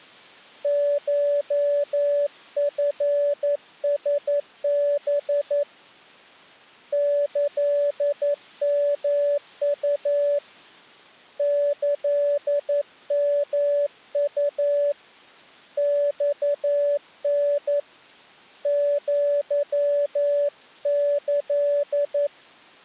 Morse code (Japanese Wabun code), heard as a keyed tone, hand-sent with a paddle, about 11 wpm, 580 Hz. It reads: コチラハ キヨウ キヨウ マタ アキ